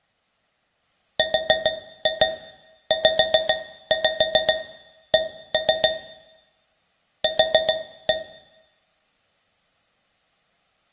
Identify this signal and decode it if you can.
Tap code, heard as taps on a metal pipe, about 7 knocks a second, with room echo. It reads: RZC Q